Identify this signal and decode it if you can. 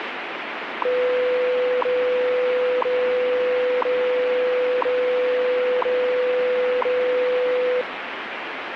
Radio time signal (WWV, Colorado), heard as ticks, one a second, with radio static.